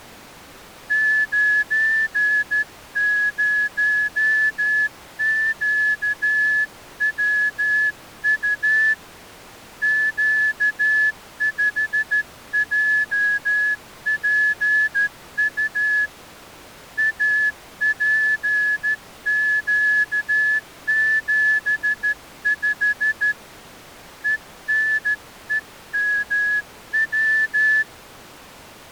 Morse code, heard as a whistle, hand-sent with a straight key, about 13 wpm. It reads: 90QWU Q5JPU APQ75 ENEMW